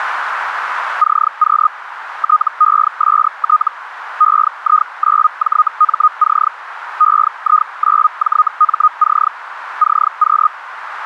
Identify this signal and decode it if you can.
Hellschreiber (Feld-Hell, 122.5 baud), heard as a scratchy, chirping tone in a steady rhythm, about 1240 Hz, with radio static. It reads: CQ TEST EI9JMC EI9JMC CQ